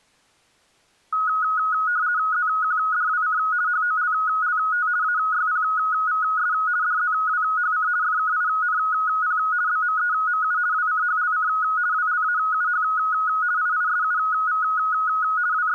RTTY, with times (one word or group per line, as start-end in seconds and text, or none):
2.3-3.4 ZQDWC
3.7-4.9 HOLLT
5.0-6.5 AYPVS
6.8-7.9 DZWHC
8.0-9.4 FKINP
9.7-10.6 BMEMU
10.7-11.5 WCHLC
11.9-12.8 WLAUH
13.6-14.6 IISUV
15.5-15.7 …